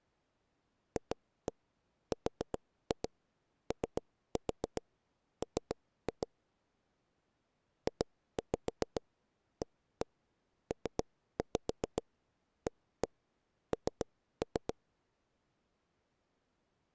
Tap code, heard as taps on a table, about 7 knocks a second. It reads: FROM JAPAN